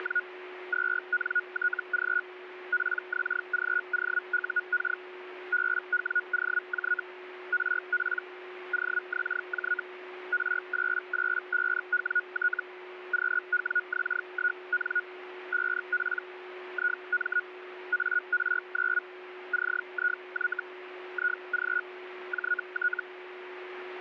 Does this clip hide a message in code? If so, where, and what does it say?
Yes: Hellschreiber (Feld-Hell, 122.5 baud) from 0.0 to 23.0 s, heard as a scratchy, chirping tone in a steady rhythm, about 1450 Hz, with radio static and a steady whistle near 360 Hz. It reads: … 2NTG PXGOUK BWOJ RP OXJ R885WT QWX1N 5P IM AR9 CIY IG JT